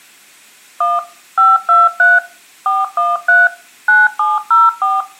DTMF, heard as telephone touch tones, dialled by machine, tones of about 190 ms, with room echo. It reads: 1 523 413 9704